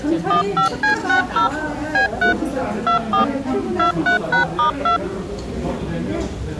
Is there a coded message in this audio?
Yes: DTMF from 0.3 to 5.0 s, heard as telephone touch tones, dialled by machine, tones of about 110 ms, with the noise of a restaurant. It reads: 15C60 B3 24 23#*2